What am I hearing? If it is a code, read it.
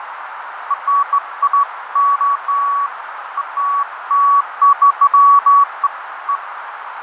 Beeps of irregular length, with radio static, fading and a narrow filter. There is no code.